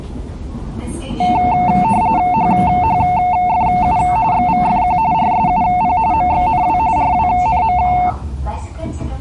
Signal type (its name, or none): RTTY